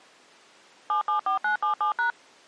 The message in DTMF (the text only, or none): 774977#